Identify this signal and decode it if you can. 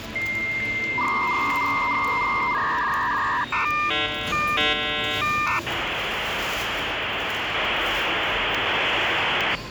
Dial-up modem handshake (V.34 or later), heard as a whistle, warbles, then hiss, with phone line noise and the noise of a subway station.